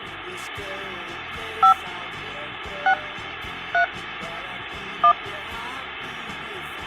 DTMF, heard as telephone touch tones, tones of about 80 ms. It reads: 5 6 3 1